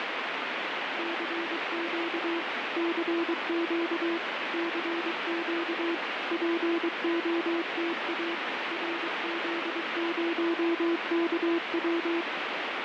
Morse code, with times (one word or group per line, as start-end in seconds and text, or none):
1.0-2.4 CQ
2.8-4.2 CQ
4.5-5.9 CQ
6.3-8.3 POTA
8.7-12.2 RZ0KW